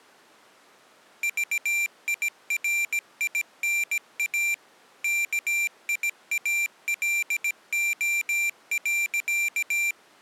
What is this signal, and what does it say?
Morse code, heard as a high beeper, machine-sent, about 17 wpm, 2350 Hz. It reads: VIRINA KIALO.